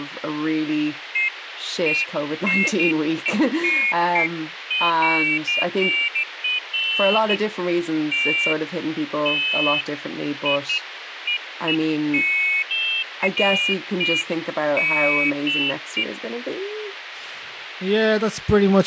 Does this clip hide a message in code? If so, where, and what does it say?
No, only pairs of high tones at irregular times, with radio hiss and speech in English.